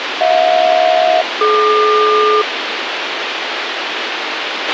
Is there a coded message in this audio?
Yes: aircraft SELCAL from 0.2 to 2.4 s, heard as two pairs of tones, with radio hiss and a squelch burst at the end. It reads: HJ-DQ